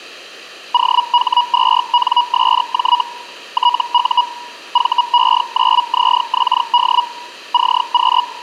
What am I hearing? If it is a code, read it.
Hellschreiber (Feld-Hell, 122.5 baud), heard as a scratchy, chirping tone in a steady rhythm, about 970 Hz. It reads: OH2NSJ TU VE9ZXD CQ